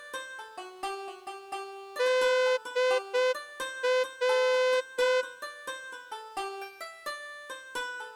Morse code (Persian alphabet), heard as a horn, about 6 wpm. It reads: در